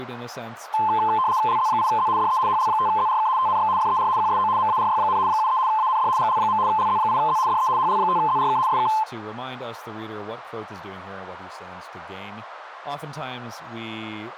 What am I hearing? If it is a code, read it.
RTTY (75 baud, 170 Hz shift), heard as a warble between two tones, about 960 Hz centre, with radio static and speech in English. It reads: LZ8Z DE HL5ZRK TNX FER QSO MARY, 73 AND GL. LZ8Z DE HL5ZRK SK